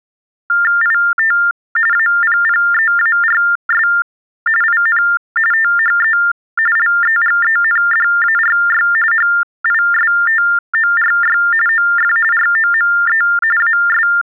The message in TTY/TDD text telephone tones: IT APPEARS IN THE LEGENDARY HISTORY OF ROME AS

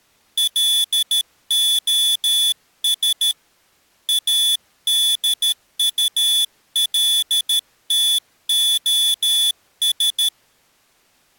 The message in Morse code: LOS ADULTOS

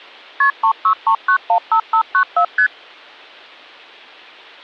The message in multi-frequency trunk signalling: KP 363915594 ST

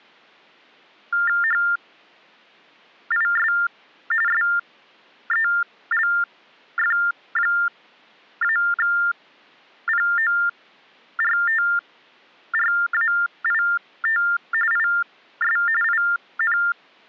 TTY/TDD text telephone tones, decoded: HIS SELF-PORTRAIT IS IN

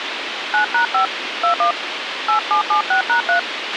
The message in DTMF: 9#5 21 8776#3

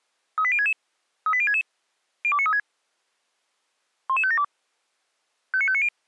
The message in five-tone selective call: 38066 38066 02936 11572 59590

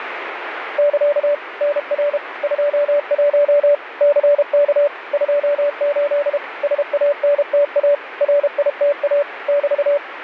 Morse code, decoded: <KA> NR 21 CK 28 SANTA RITA <BT>

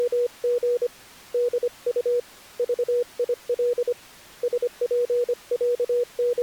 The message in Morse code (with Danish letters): … DU VIL …

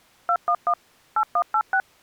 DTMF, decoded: 211 8186

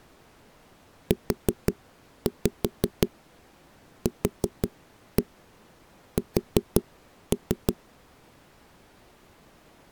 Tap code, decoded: UQS

